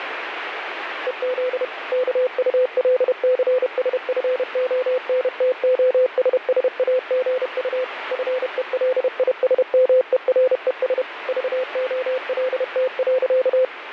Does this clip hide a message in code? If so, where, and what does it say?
Yes: Morse code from 1.0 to 13.7 s, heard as a keyed tone, machine-sent, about 31 wpm, 510 Hz, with radio static. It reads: EZ KULCSFONTOSSAGU FELISMERES VOLT.